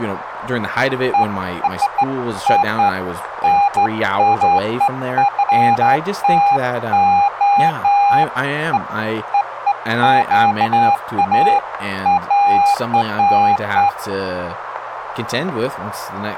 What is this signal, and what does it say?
Beeps of irregular length, with radio static and speech in English. There is no code.